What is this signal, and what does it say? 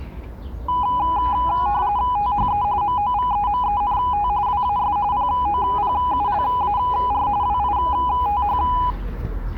RTTY (45.45 baud, 170 Hz shift), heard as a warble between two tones, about 910 Hz centre, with the noise of a residential street. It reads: THE MOVEMENT WAS POPULAR WITH